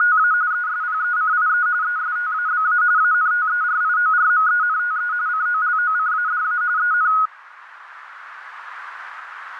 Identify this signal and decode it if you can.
RTTY (45.45 baud, 170 Hz shift), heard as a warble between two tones, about 1360 Hz centre, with radio static and a narrow filter. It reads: … ESPECIE ESTABA ANTERIORMENTE COLOCADA EN